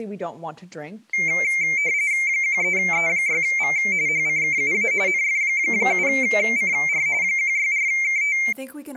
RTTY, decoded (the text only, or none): 13E6V HCKUA NF7CR 164KT